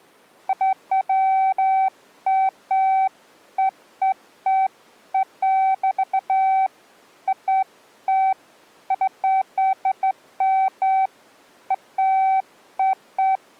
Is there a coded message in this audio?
No, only beeps of irregular length.